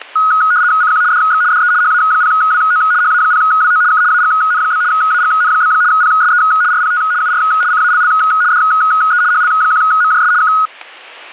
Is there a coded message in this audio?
Yes: RTTY (75 baud, 170 Hz shift) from 0.2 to 10.7 s, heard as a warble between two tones, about 1360 Hz centre, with static crashes. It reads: CQ DX DE HA0WO HA0WO K AGN? AGN? PSE RPT UR CALL DE HL1MJS K